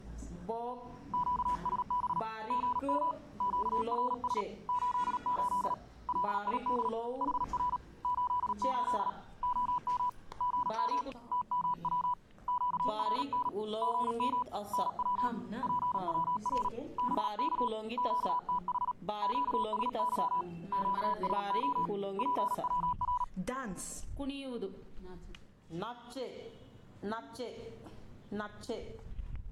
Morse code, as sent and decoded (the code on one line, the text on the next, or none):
--.- ... -... / --. -- / --.- .-. ... / ---.. ---.. / .-.. .. -.. / .... .-. / ---.. ---.. / --- -- / --. -- / - -- .-- / --.- .-. -. / --. -- / -. .-- / .--. .-- .-. / -... -.- / --.- - .... / --.- ... -.-- / --.- ... --- / .--. .-- .-.
QSB GM QRS 88 LID HR 88 OM GM TMW QRN GM NW PWR BK QTH QSY QSO PWR